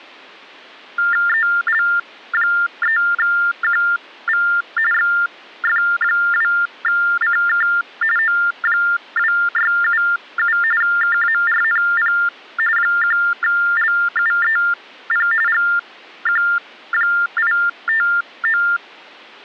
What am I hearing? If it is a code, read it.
TTY/TDD text telephone tones (45.45 baud Baudot), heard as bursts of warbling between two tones, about 400 Hz shift, 1600 Hz centre. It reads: EL3QV XF2CK O2677 KARNP 1LUEP GQ859